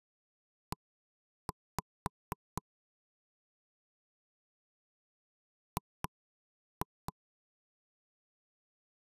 Tap code, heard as knocks on wood, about 4 knocks a second. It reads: E G